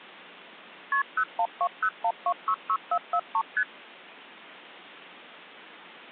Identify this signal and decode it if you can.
Multi-frequency trunk signalling (R1, as on North American trunks), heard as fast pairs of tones, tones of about 70 ms. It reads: KP 01201266443 ST